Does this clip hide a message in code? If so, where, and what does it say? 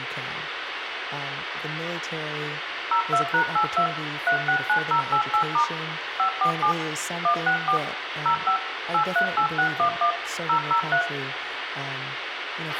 Yes: DTMF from 2.9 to 11.0 s, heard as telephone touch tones, dialled by machine, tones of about 90 ms, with radio hiss, a squelch burst at the end, room echo and speech in English. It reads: 02#82 369088* 547 164 05 838611 003